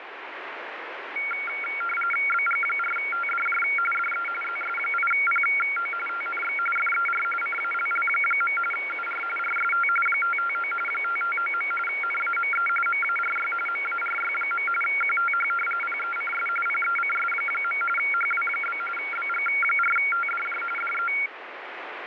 RTTY (45.45 baud, 850 Hz shift), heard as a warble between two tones, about 1800 Hz centre, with radio static. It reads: BG4TDJ DE ZS8PO TNX FER CALL. UR RST 559 559. NAME MARY MARY. QTH PECS PECS. HW? BG4TDJ DE